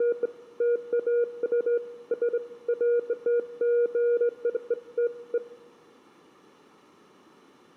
Beeps of irregular length, with room echo. There is no code.